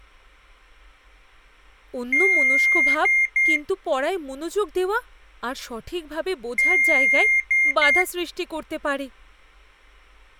Beep code, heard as beeps from a small speaker, played twice, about 2100 Hz, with speech in Bangla. 1 long, 2 short. In Award, IBM and AMI BIOS tables: video adapter failure.